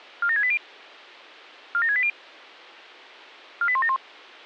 Five-tone selective call (ZVEI), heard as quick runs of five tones, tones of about 70 ms. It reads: 47680 47680 48171